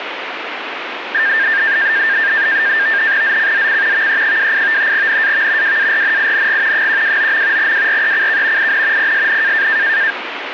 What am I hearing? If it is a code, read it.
NAVTEX (SITOR-B), 100 baud, 170 Hz shift, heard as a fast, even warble, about 1700 Hz centre, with radio static. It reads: ZCZC VE28 NAV WARNING 129. WRECK IN PSN